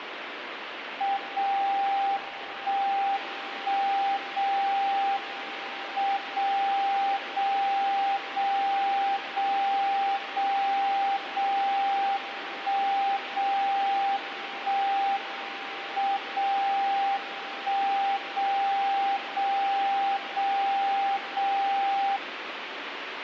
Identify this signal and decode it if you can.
Radio time signal (WWVB), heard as a tone whose level steps once a second, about 790 Hz, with radio static. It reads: 0 1 1 0 M 0 0 0 0 0 0 1 0 1 M 0 1 0 0 0 0